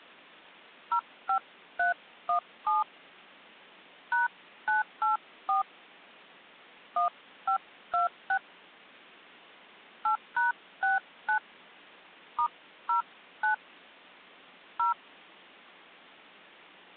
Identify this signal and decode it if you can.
DTMF, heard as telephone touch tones, dialled by hand, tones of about 120 ms. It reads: 05317 #984 1526 8#69 *09 0